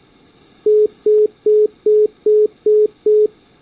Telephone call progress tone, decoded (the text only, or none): congestion tone